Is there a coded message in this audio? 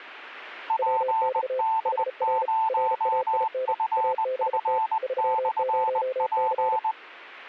Yes: Morse code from 0.6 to 7.0 s, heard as two keyed tones. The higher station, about 20 wpm, 880 Hz: PD0FF/P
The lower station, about 34 wpm, 520 Hz: WX HR RAIN ABT 30C